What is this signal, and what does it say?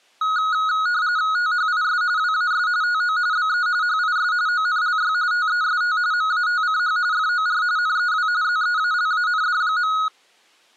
RTTY (45.45 baud, 170 Hz shift), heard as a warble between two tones, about 1360 Hz centre. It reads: THIS WAS TO BE HIS ONLY TEST MATCH FOR NEW ZEALAND.